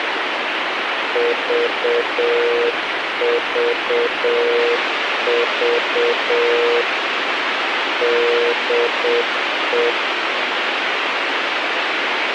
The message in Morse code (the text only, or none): VVV DE